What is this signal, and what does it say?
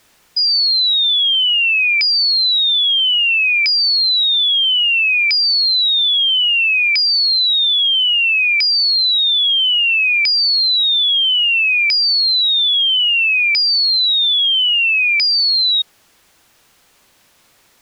A tone that sweeps in pitch again and again. There is no code.